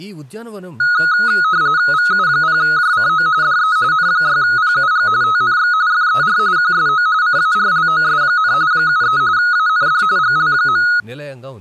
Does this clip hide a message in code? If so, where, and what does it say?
Yes: RTTY (45.45 baud, 170 Hz shift) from 0.8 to 11.0 s, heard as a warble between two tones, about 1360 Hz centre, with speech in Telugu. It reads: VU0JCO DE N6PUG TNX FER QSO CARLOS, 73 AND GL.